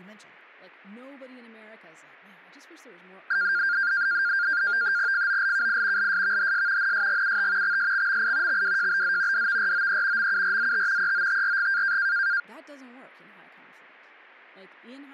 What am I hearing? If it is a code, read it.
NAVTEX (SITOR-B), 100 baud, 170 Hz shift, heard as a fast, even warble, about 1500 Hz centre, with speech in English. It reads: FOLKI LSVHS NSGUT XSXMI XWJBZ DVROE MURZT EOTRG